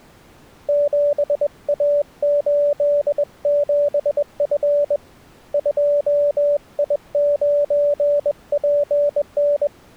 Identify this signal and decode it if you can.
Morse code, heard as a keyed tone, hand-sent with a bug key, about 21 wpm, 580 Hz. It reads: 7A87F 2I9PN